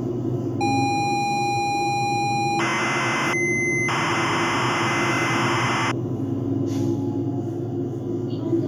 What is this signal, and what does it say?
ZX Spectrum tape loading, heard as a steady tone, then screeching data, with the noise inside a bus.